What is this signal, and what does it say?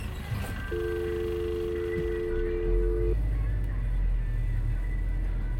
Telephone call progress tone (North American or UK plan), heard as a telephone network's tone, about 350, 440 Hz, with the noise inside a bus. Dial tone.